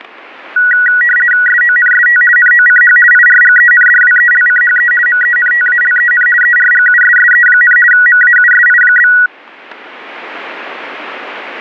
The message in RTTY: SONST NOCH IRGENDWELCHE MENTALEN ERGUSSE, MAUSI?

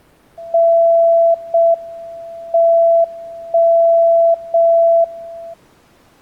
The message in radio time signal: 0 M 1 0 1

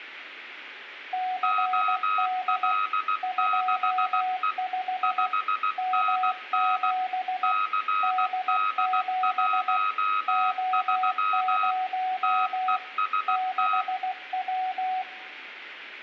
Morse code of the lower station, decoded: CD 25 M7 D7 O0 6W

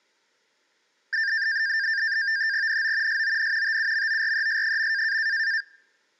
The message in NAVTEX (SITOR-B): NO SON TUMORES.

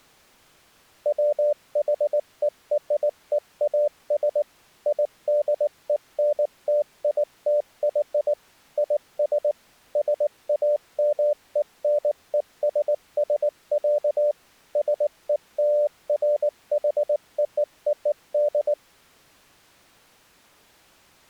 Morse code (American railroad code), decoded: WHEREAS IDENTITY IS SAMENESS, SELFHOOD

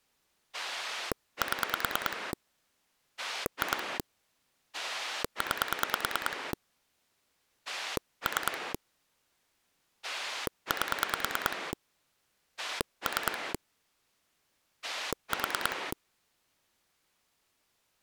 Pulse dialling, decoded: 7 2 9 3 8 3 4

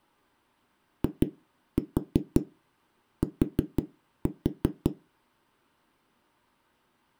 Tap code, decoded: IT

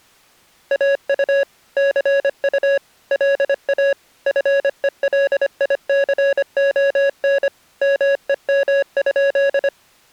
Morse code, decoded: AU CU LA FELICON MEM?

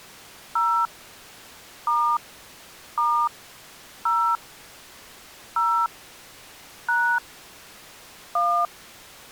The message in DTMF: 0 * * 0 0 # 1

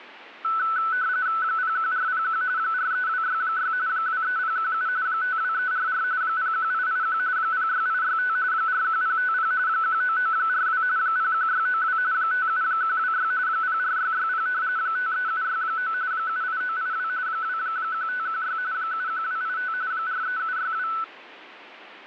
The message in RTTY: 01401 43266 23017 52344 01881 06865 41050 19942 01692 57126 04660 53769 78982 21516 71285 43762

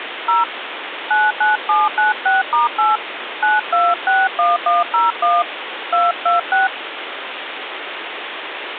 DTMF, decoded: 0 99796*8 9261101 226

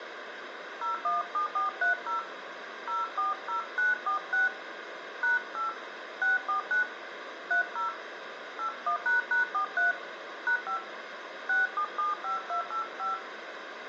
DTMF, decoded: 017430 040946 #8 649 30 81##43 #5 6775285

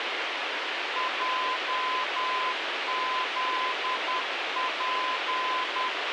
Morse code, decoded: JZP

